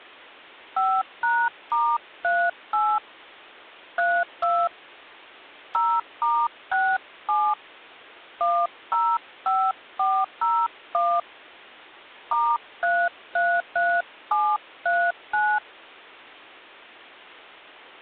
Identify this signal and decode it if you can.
DTMF, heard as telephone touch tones, dialled by hand, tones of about 250 ms. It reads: 5#*38 32 0*67 105401 *333739